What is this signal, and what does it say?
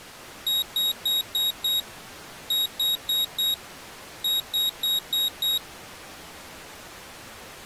Beep code, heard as a piezo beeper, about 3800 Hz. 5-4-5.